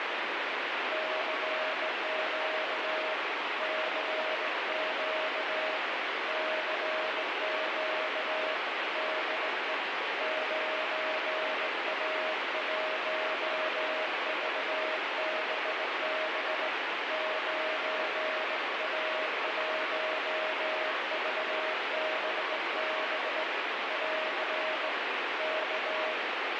Morse code, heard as a keyed tone, hand-sent with a straight key, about 18 wpm, 630 Hz, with heavy radio static. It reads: CQ CQ CQ DE 9A1VBB 9A1VBB <AR> K